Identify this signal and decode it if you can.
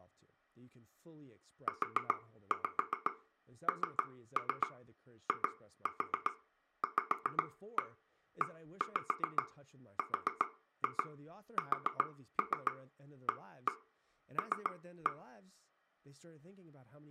Tap code, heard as taps on a table, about 7 knocks a second, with speech in English. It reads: UNIVERSAL